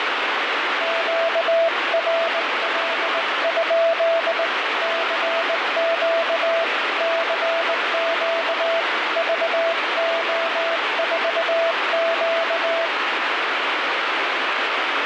Morse code, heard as a keyed tone, hand-sent with a straight key, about 19 wpm, 660 Hz, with heavy radio static. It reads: QRL? CQ CQ VO4Q